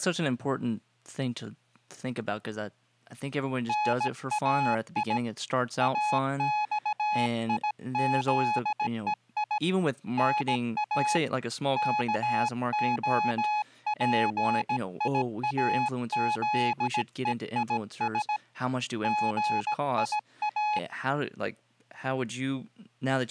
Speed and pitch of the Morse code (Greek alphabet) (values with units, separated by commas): 17 wpm, 840 Hz